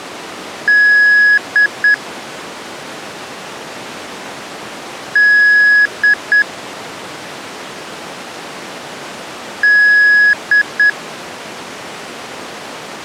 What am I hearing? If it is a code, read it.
Beep code, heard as beeps, played three times, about 1700 Hz. 1 long, 2 short. In Award, IBM and AMI BIOS tables: video adapter failure.